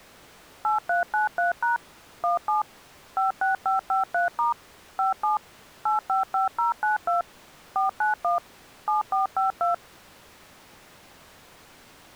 DTMF, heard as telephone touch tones, dialled by machine, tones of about 140 ms. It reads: 8393# 17 56553* 57 855092 491 7452